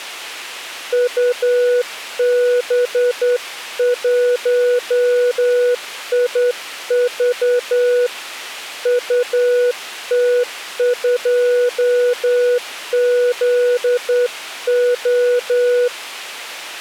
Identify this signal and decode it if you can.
Morse code, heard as a keyed tone, hand-sent with a straight key, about 10 wpm, 490 Hz. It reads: UB1IV UT2ZO